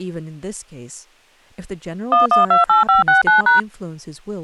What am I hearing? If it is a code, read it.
DTMF, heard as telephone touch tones, dialled by machine, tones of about 140 ms, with speech in English. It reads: 1128569#